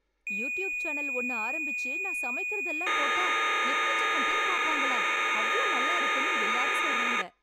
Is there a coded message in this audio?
Yes: cassette data (Kansas City type), 1200 baud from 0.3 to 7.2 s, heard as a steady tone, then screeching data, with speech in Tamil.